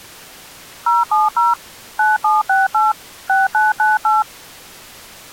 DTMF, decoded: 070 9768 6998

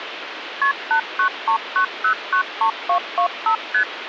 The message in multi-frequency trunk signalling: KP 8939093225 ST

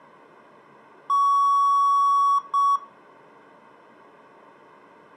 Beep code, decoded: 1 long, 1 short

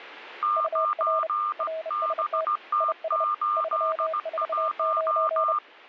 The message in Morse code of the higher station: 9BT81

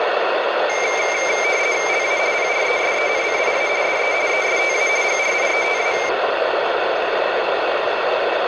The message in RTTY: LA PRESENCIA DE ESTA GRIETA

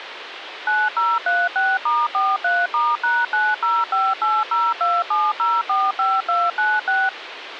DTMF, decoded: 9036*43*#9058027045296

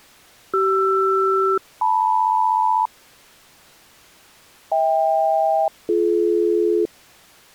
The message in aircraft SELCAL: CR-LM HK-BD

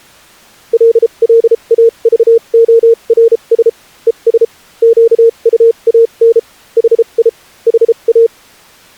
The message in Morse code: LLAVORS ES QUAN HI HA

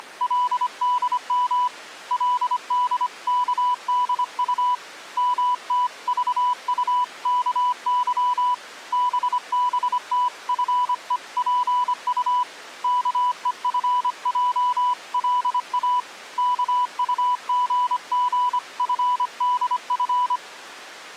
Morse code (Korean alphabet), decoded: … 그의 머리에 떠나지 않고 있는

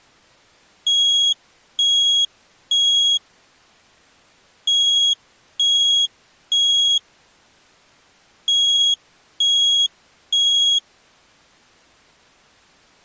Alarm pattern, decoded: temporal three

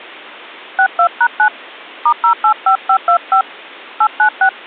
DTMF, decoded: 62#9 *085525 896

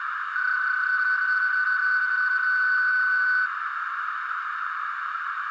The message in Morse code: none

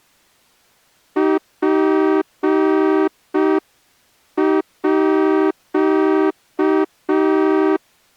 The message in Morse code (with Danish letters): PÅ

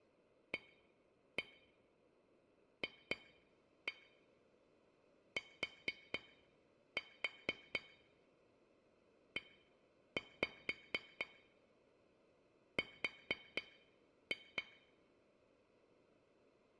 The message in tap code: AFTER

